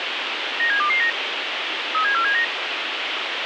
Five-tone selective call (CCIR), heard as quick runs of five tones, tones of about 100 ms, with radio hiss. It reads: 97229 37479